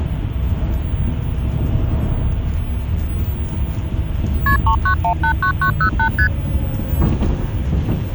Multi-frequency trunk signalling (R1, as on North American trunks), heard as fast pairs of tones, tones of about 90 ms, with the noise inside a bus. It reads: KP 39189908 ST